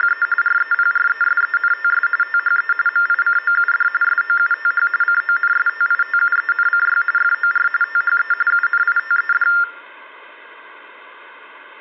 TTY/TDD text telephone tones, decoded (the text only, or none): … REPRESENTS THE MICOUD SOUTH CONSTITUENCY FOR THE UNITED